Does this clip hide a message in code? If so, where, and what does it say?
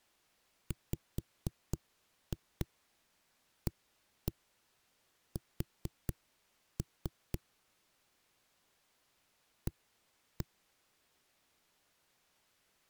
Yes: tap code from 0.7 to 10.5 s, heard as knocks on a wall, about 4 knocks a second. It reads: WAS A